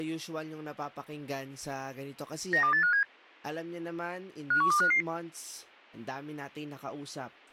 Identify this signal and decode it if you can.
Five-tone selective call (CCIR), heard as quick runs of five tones, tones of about 100 ms, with speech in Filipino. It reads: 92857 51255